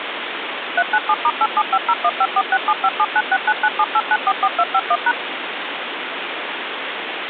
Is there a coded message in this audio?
Yes: DTMF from 0.8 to 5.1 s, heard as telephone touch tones, dialled by machine, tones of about 50 ms, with phone line noise. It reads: 397*87501546757969978944251#